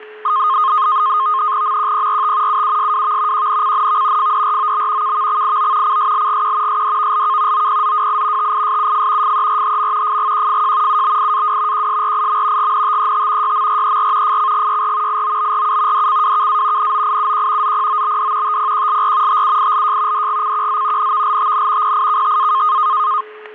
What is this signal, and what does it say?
NAVTEX (SITOR-B), 100 baud, 170 Hz shift, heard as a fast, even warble, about 1150 Hz centre, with static crashes and a steady whistle near 430 Hz. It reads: MQPRT UUSWV QNCNV FDROB KVXIO CSLGQ SDVLK OPZWI TISUF FERHM FGQFJ UBIAW QSRIM GNTET YMRER FCGYR IOBRU DCWKA NOIUQ ZPOBD TPQLR TUILJ DGCQZ NVLTN PIKTA